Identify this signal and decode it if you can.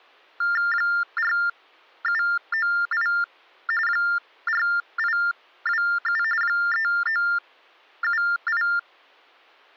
TTY/TDD text telephone tones (45.45 baud Baudot), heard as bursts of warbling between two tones, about 400 Hz shift, 1600 Hz centre. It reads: 4798 4827 3978